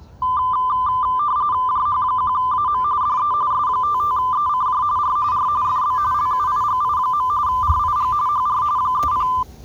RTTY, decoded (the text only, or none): JH1AM DE S55ECJ R R FB LUIGI. RIG HR 30